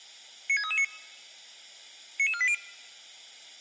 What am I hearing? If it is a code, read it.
Five-tone selective call (ZVEI), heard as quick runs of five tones, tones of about 70 ms. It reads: 96339 99480